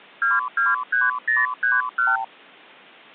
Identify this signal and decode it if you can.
Multi-frequency trunk signalling (R2, with the far end's replies), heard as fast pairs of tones, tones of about 180 ms. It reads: 223031